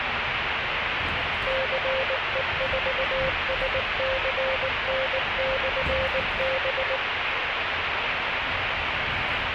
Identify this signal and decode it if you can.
Morse code, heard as a keyed tone, machine-sent, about 19 wpm, 530 Hz, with radio static and the noise inside a bus. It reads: CE4SCN/B